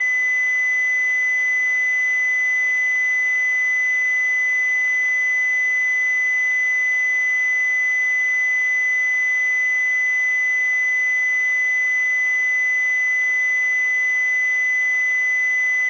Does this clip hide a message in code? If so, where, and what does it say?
No, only a steady tone.